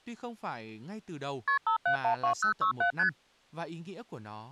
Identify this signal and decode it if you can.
Multi-frequency trunk signalling (R1, as on North American trunks), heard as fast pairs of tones, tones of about 100 ms, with speech in Vietnamese. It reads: KP 5712067 ST